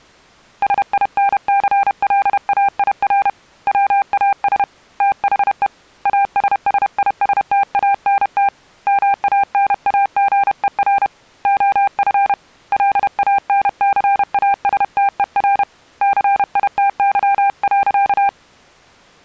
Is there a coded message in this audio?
Yes: Morse code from 0.6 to 18.4 s, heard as a keyed tone, hand-sent with a paddle, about 31 wpm, 800 Hz. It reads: SINCLAIR WAS THE ASSISTANT MANAGER OF LANCASTER CITY.